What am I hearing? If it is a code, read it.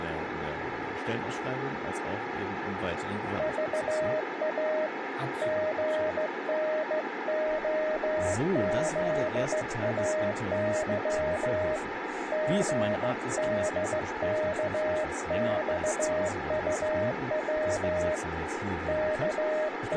Morse code, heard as a keyed tone, hand-sent with a straight key, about 15 wpm, 620 Hz, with radio static and speech in German. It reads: VA GNOZAY GDKXUW …